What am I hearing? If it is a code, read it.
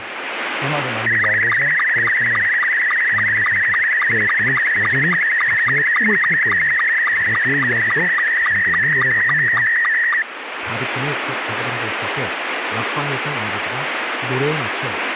SSTV (slow-scan television), Scottie S2, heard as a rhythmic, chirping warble, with radio static and speech in Korean.